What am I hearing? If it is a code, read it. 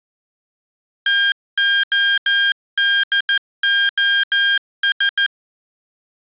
Morse code, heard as electronic beeps, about 14 wpm, 1600 Hz. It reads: TODOS